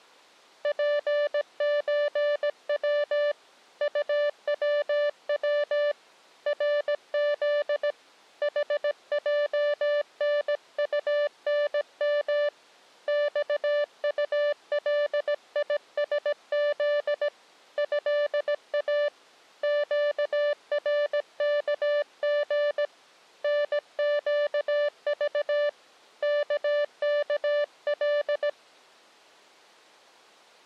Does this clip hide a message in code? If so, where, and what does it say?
Yes: Morse code (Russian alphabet) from 0.6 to 28.6 s, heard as a keyed tone, hand-sent with a paddle, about 17 wpm, 590 Hz. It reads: ПЧВ УВВ РЗ ХЙНУНМ ЬУЛИСЗ ЭА ЩРКГ НЩЖ ККЛ